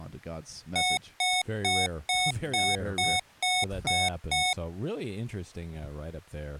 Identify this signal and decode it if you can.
Beep code, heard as beeps from a small speaker, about 730 Hz, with speech in English. 9 short. In AMI BIOS tables: ROM checksum failure.